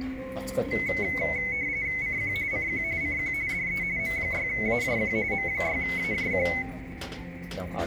RTTY (45.45 baud, 170 Hz shift), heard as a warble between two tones, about 2150 Hz centre, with radio static and the noise of a restaurant. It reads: CQ CQ CQ DE M6AJQ M6AJQ